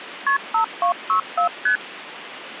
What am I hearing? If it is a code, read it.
Multi-frequency trunk signalling (R1, as on North American trunks), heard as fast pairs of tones, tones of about 100 ms, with phone line noise. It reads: KP 5264 ST